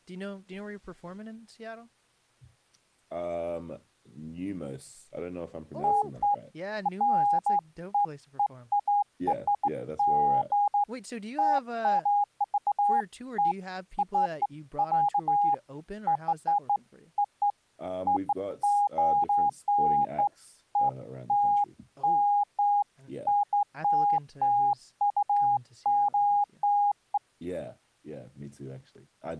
Beeps of irregular length, with speech in English. There is no code.